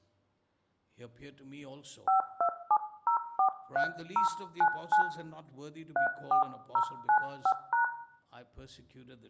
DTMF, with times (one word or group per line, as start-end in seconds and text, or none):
2.1-5.0 527043099
6.0-7.8 34095#